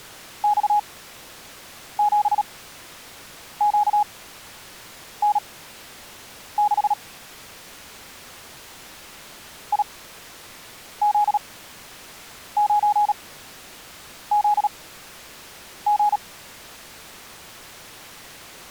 Morse code, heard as a keyed tone, machine-sent, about 37 wpm, spaced as for 7 wpm, 830 Hz. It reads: X7QN6 IZ9ZG